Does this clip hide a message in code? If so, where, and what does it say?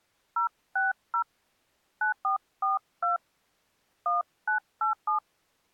Yes: DTMF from 0.4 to 5.2 s, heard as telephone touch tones, dialled by hand, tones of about 140 ms. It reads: 060 9442 1987